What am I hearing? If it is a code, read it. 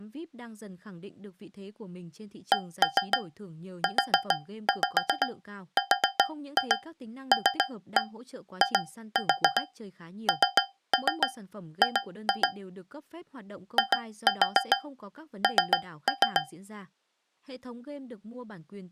Tap code, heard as taps on a metal pipe, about 7 knocks a second, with speech in Vietnamese. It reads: CURLING IN